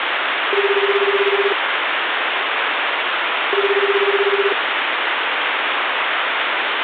Telephone call progress tone (Japanese plan), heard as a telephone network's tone, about 380, 400, 420 Hz, 1 s on and 2 s off, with phone line noise. Ringback tone.